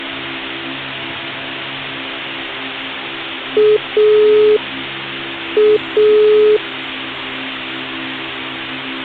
Telephone call progress tone (pulsed, as in Italy), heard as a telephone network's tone, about 420 Hz. Dial tone.